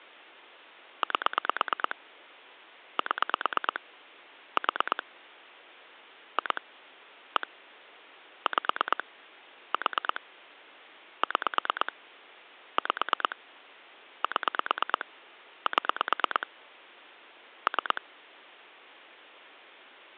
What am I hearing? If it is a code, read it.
Pulse dialling, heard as clicks on a phone line, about 9 pulses a second. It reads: 8 7 4 2 1 5 4 6 5 7 7 3